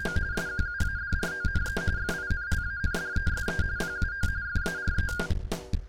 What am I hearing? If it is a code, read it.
RTTY (45.45 baud, 170 Hz shift), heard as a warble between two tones, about 1500 Hz centre. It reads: … SQUADRONE FINLANDESE PUO FARE